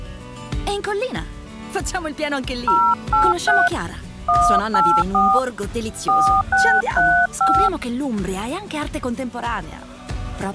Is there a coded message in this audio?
Yes: DTMF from 2.7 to 7.7 s, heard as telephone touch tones, dialled by hand, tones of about 270 ms. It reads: 083 184 4635